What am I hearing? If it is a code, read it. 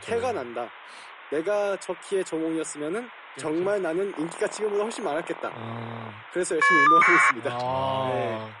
Caller ID data burst, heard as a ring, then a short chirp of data, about 1200 baud, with speech in Korean.